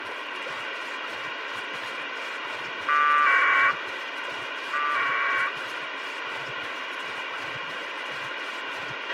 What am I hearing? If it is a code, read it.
Packet radio (AX.25, as in APRS), 1200 baud, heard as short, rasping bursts, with radio hiss and a squelch burst at the end.